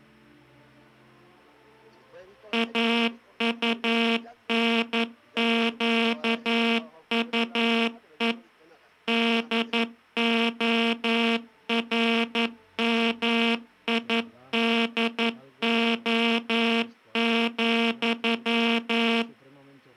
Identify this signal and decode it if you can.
Morse code, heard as a buzzer, machine-sent, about 11 wpm. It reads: AUNQUE DORMIDO,